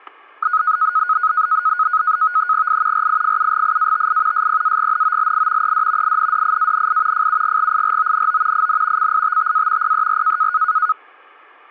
NAVTEX (SITOR-B), 100 baud, 170 Hz shift, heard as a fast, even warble, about 1360 Hz centre, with static crashes. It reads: I RIFUGIATI SPAGNOLI ED INDIANI FUGGIRONO IN CITTA PER